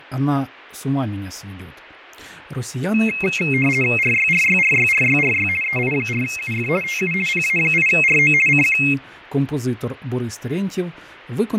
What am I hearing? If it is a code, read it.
RTTY (50 baud, 450 Hz shift), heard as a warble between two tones, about 2350 Hz centre, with radio static and fading. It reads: RYRYRYRYRY EI4UF TU PA8RO CQ